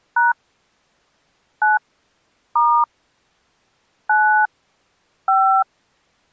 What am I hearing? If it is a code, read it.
DTMF, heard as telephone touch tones, dialled by hand, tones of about 260 ms. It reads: # 9 * 9 5